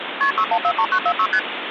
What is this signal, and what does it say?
Multi-frequency trunk signalling (R1, as on North American trunks), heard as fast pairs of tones, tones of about 70 ms, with phone line noise. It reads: KP 6143946 ST